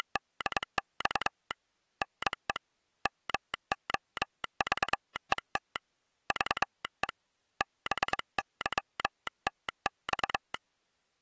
Morse code (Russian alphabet), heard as a telegraph sounder, hand-sent with a straight key, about 22 wpm. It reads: … НЕ МОЖЕТ ЖЕ БЫТЬ